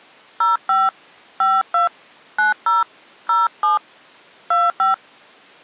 DTMF, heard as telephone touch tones, dialled by hand, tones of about 150 ms. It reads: 05 52 90 07 25